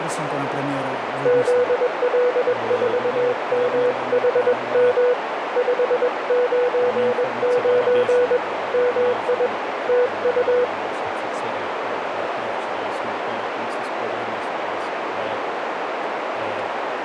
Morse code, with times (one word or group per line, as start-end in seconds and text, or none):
1.3-5.1 ZL4MHM
5.6-8.4 599
8.7-9.5 MI
9.9-10.6 TU